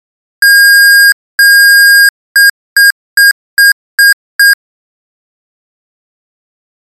Beep code, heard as beeps from a small speaker, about 1600 Hz. 2 long, 6 short.